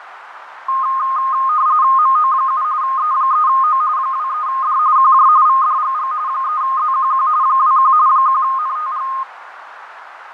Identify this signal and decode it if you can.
RTTY (45.45 baud, 170 Hz shift), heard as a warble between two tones, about 1150 Hz centre, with radio static, fading and a narrow filter. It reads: MO7 E3O 23D QJ VDGG 3ZQQ 21 1NTG